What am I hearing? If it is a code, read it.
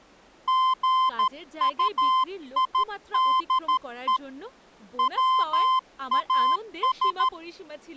Morse code, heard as a keyed tone, hand-sent with a paddle, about 13 wpm, 1040 Hz, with speech in Bangla. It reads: GUIDE WAS